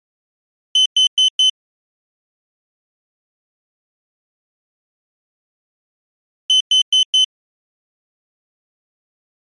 Alarm pattern, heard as an alarm's beeps, played twice, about 3050 Hz. Temporal four. Carbon monoxide.